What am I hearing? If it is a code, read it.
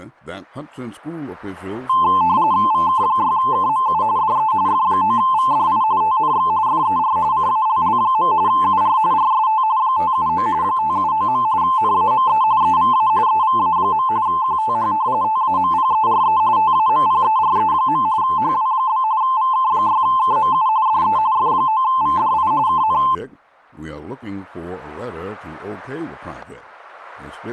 RTTY (45.45 baud, 170 Hz shift), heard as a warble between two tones, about 960 Hz centre, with static crashes. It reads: VK6KMU DE F9VDI TNX FER CALL. UR RST 579 579. NAME EVA EVA. QTH TAMPERE TAMPERE. HW? VK6KMU DE F9VDI KN